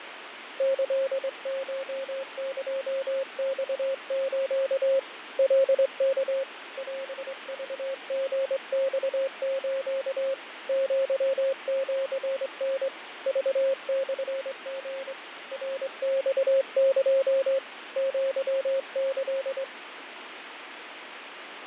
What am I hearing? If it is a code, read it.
Morse code (Japanese Wabun code), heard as a keyed tone, hand-sent with a straight key, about 23 wpm, 540 Hz, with radio static and fading. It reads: キコエマス カワ オクリマス アシタ クモリ ナマエ アキ